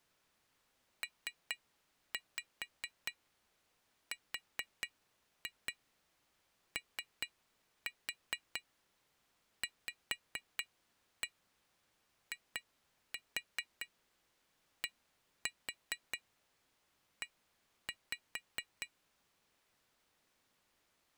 Tap code, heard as taps on glass, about 4 knocks a second. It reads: PROVIDE